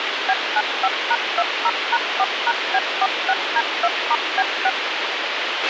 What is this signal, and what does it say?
DTMF, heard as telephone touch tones, dialled by machine, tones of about 50 ms, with radio hiss and a squelch burst at the end. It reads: B95#20#4#B46D2*B6